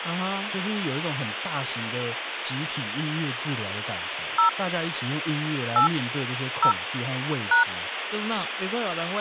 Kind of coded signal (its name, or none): DTMF